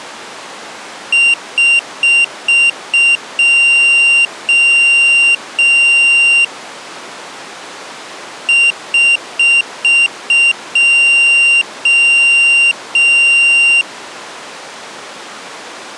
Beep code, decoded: 5 short, 3 long

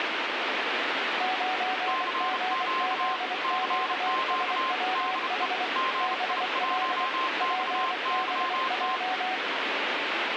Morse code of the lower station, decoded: 9GZQSWH BL PBJ

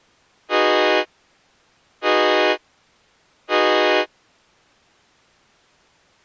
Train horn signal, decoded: 3 short

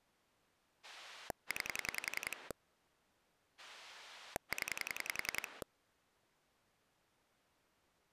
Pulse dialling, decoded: 9 0

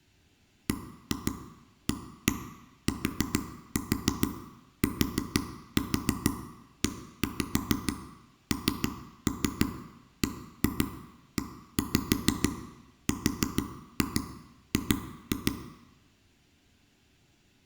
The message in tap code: BATTENBERG

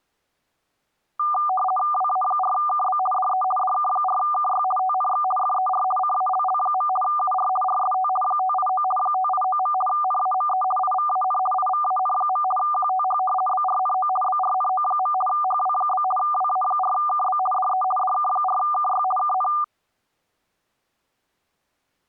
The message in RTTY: WA4KB DE DK4KY TNX FER CALL. UR RST 589 589. NAME IVAN IVAN. QTH BRNO BRNO. HW? WA4KB DE DK4KY KN

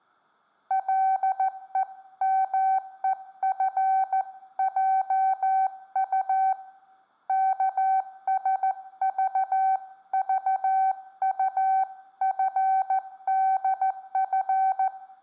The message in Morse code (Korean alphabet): 가만히 열리는

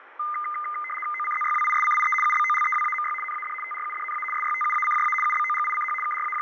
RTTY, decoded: OCZYWISCIE UBOLEWAMY NAD TRUDNA SYTUACJA UBOGICH …

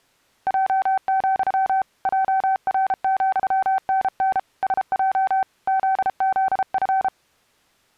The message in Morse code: J, JR,NN SJ ZZF

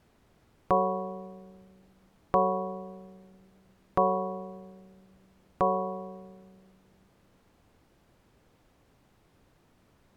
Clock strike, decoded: 4

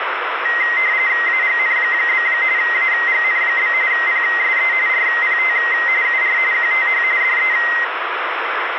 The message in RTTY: AGN? AGN? PSE RPT UR QTH DE

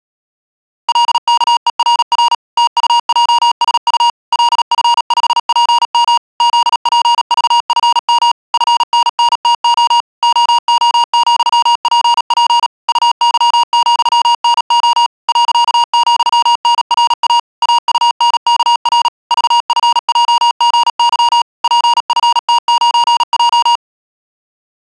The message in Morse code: LKERR TUJSU LF5PM ZPVFM FNNTO OO,PP UY,NO .,NRA AUNKR VFJGY PFT9J

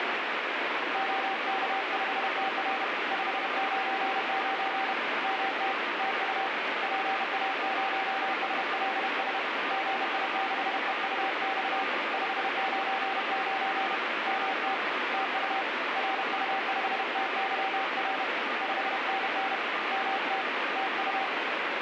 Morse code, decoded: OK5TR 599 MT TU PA0SLS GI6EUX 599 MT TU RU5TYR 5NN MT TU

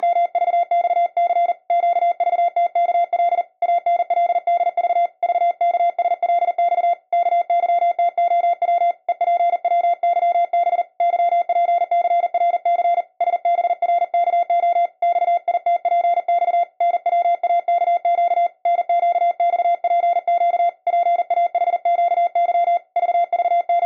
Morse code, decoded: … QVTKL ANLDV VKSLX KYTOW EPWYB YPCRC SBRKO XITPX NWAKQ NQXPQ PAHQY …

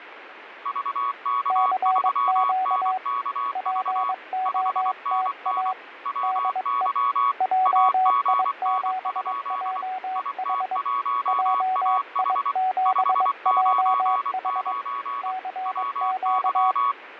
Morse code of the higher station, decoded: VK3NKV 5NN WY AGN? IT1AH 599 WY

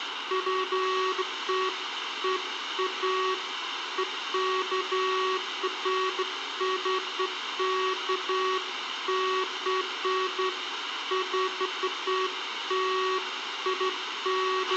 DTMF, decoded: none

